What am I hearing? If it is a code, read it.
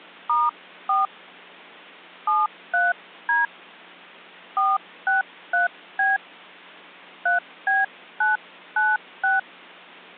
DTMF, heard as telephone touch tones, dialled by hand, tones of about 170 ms. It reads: *4 73D 463B 3B996